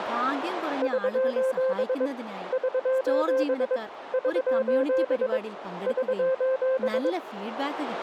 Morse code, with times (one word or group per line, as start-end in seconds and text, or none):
0.8-2.1 <SOS>
2.5-3.8 <SOS>
4.1-5.4 <SOS>
5.9-7.1 <SOS>